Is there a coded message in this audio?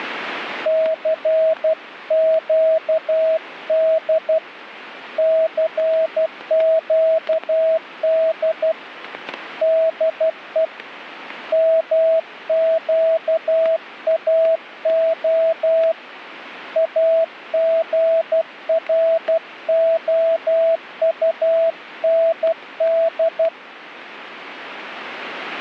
Yes: Morse code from 0.6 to 23.5 s, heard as a keyed tone, hand-sent with a paddle, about 12 wpm, 650 Hz, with static crashes. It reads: CQD CQD DE MQAO AGROUND